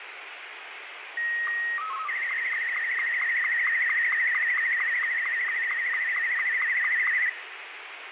SSTV (slow-scan television), Martin M2, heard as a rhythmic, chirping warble, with radio static and room echo.